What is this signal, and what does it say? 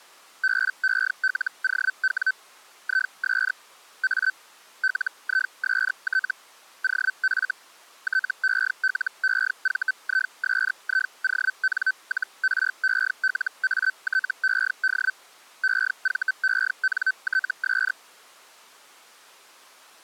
Hellschreiber (Feld-Hell, 122.5 baud), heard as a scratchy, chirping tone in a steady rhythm, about 1550 Hz. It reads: BELOW IS A LIST OF TELEVISION-RELATED EVENTS